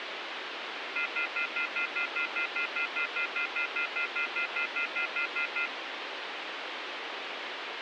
Telephone call progress tone (North American plan), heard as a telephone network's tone, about 1400, 2050, 2450, 2600 Hz, 0.1 s on and 0.1 s off, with phone line noise. Off-hook warning tone.